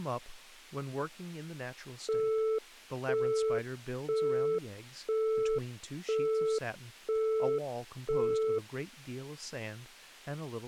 Telephone call progress tone (single-tone plan, as in Europe, Japan and elsewhere), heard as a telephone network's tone, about 440 Hz, 0.5 s on and 0.5 s off, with speech in English. Busy tone.